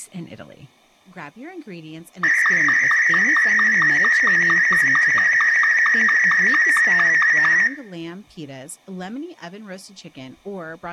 SSTV (slow-scan television), Martin M2, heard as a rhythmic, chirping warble, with room echo and speech in English.